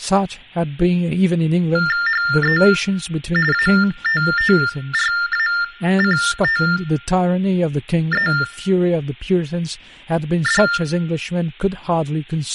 TTY/TDD text telephone tones (45.45 baud Baudot), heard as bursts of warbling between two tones, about 400 Hz shift, 1600 Hz centre, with speech in English. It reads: HE ATTRACTED